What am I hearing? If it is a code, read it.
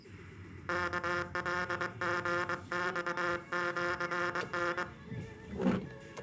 Morse code (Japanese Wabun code), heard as a buzzer, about 22 wpm, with the noise inside a car. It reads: ワカリマシタ